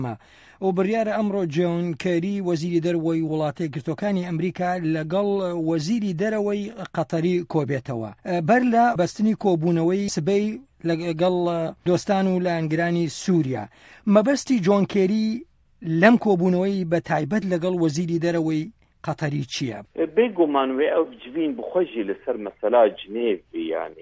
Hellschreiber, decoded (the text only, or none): none